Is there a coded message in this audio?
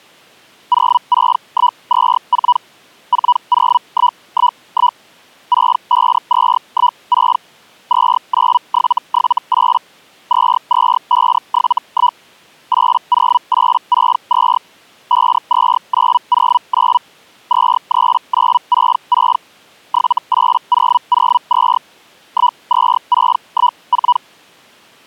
Yes: Hellschreiber (Feld-Hell, 122.5 baud) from 0.7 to 24.2 s, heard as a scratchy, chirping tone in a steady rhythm, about 980 Hz. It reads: 06124 40111 65216 29778 22571 80862 52909 23966 78002 12614